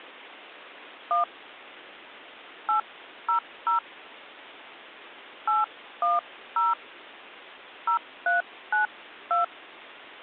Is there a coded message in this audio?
Yes: DTMF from 1.1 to 9.4 s, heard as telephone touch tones, dialled by hand, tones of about 120 ms. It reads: 1 800 810 0392